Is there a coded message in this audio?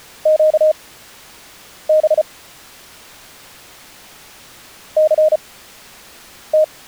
Yes: Morse code (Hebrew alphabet) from 0.2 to 6.7 s, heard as a keyed tone, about 34 wpm, spaced as for 7 wpm, 620 Hz. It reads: קב סת